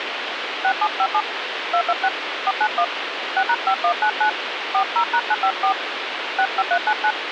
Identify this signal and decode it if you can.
DTMF, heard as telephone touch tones, dialled by hand, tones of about 70 ms, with phone line noise. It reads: 6757 226 491 6#5199 40#954 65399